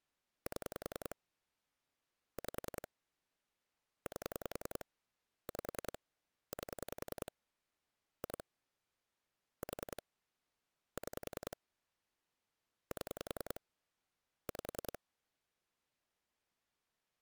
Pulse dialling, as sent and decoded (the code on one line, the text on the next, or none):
7 / 5 / 8 / 5 / 8 / 2 / 4 / 6 / 7 / 5
7 5 8 5 8 2 4 6 7 5